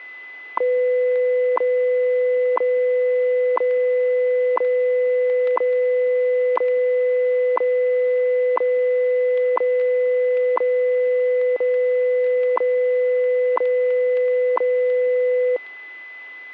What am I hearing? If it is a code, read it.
Radio time signal (WWV, Colorado), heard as ticks, one a second, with static crashes and a steady whistle near 2010 Hz.